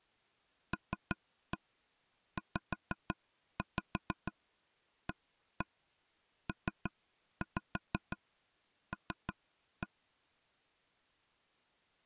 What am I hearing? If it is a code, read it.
Tap code, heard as taps on a table, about 6 knocks a second. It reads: LZAPL